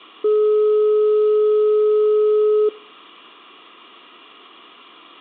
Telephone call progress tone (425 Hz plan, as in most of Europe), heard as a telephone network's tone, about 420 Hz. Dial tone.